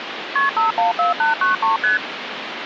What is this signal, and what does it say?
Multi-frequency trunk signalling (R1, as on North American trunks), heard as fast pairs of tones, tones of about 140 ms, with phone line noise. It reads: KP 514893 ST